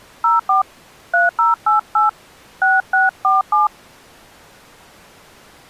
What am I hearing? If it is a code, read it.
DTMF, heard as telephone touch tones, dialled by hand, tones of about 150 ms. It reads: 04 3088 6647